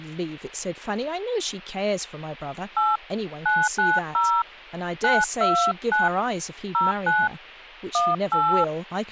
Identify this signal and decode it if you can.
DTMF, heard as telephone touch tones, dialled by hand, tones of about 240 ms, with speech in English. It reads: 8 990 929 09 18